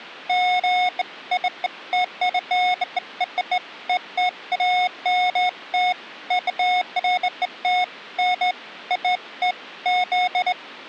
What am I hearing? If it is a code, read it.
Beeps of irregular length. There is no code.